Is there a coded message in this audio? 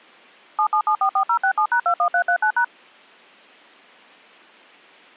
Yes: DTMF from 0.6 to 2.6 s, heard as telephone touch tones, dialled by machine, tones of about 80 ms. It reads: 77744067#21339#